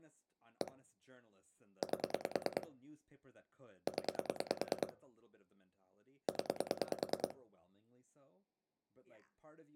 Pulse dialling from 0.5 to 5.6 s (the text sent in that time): 1 8 0